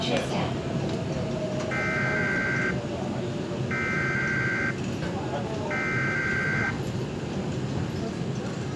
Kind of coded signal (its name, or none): Emergency Alert System (SAME) tones